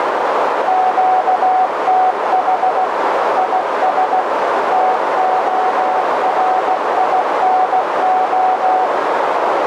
Morse code, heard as a keyed tone, machine-sent, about 16 wpm, 750 Hz, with heavy radio static and a narrow filter. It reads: QTH IS TORINO